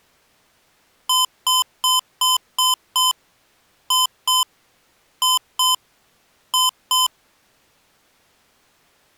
Beep code, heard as beeps from a small speaker, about 1020 Hz. 6-2-2-2.